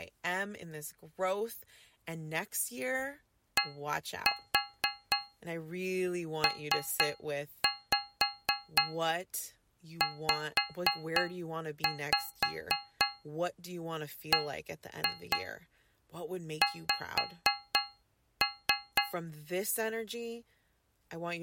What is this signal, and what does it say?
Tap code, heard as taps on a metal pipe, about 4 knocks a second, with speech in English. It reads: DPZBX